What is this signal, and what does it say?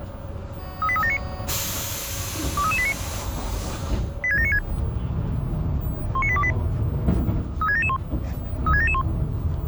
Five-tone selective call (ZVEI), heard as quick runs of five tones, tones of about 70 ms, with the noise inside a bus. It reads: 38379 23389 86796 19828 36771 36771